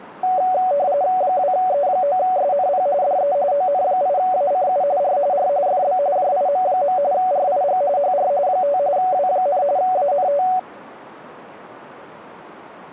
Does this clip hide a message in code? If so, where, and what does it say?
Yes: RTTY (45.45 baud, 170 Hz shift) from 0.2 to 10.6 s, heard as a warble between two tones, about 660 Hz centre. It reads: 2E9SNP DE ON8ACU R R FB JIM. RIG HR 5 W, ANT